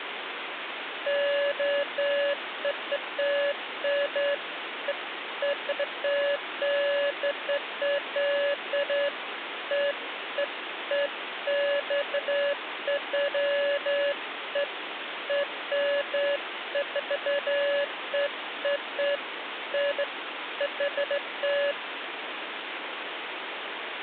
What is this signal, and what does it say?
Beeps of irregular length, with phone line noise. There is no code.